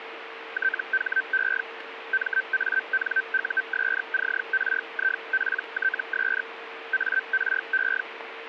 Hellschreiber (Feld-Hell, 122.5 baud), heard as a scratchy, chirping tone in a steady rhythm, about 1550 Hz, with radio static and a steady whistle near 460 Hz. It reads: THE MANUSCRIPTS ARE